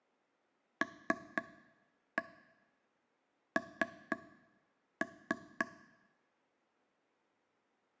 Tap code, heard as taps on a table, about 3 knocks a second, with room echo. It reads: LN